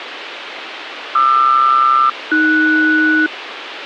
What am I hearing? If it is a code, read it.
Aircraft SELCAL, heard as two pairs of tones, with radio hiss. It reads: QR-AS